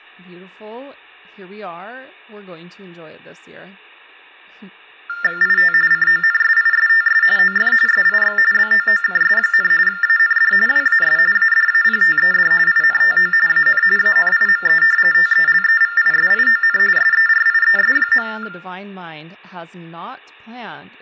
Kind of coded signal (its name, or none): TTY/TDD text telephone tones